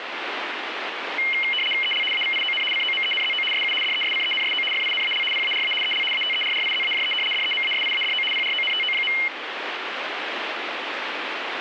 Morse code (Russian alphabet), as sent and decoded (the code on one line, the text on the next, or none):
none